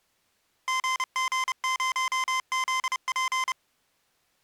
Morse code, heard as electronic beeps, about 30 wpm, 1040 Hz. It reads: GG0ZP